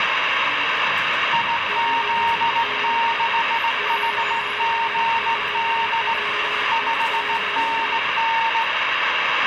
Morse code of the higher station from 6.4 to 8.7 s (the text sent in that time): 5NN